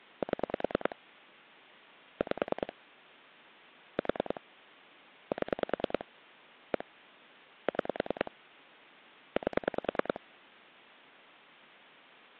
Pulse dialling, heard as clicks on a phone line, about 10 pulses a second. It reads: 7 5 4 7 1 6 8